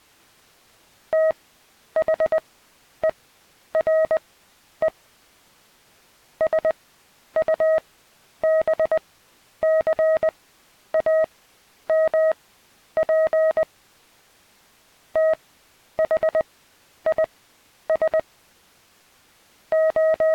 Morse code, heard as a keyed tone, machine-sent, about 20 wpm, spaced as for 10 wpm, 640 Hz. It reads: THERE SUBCAMP THIS …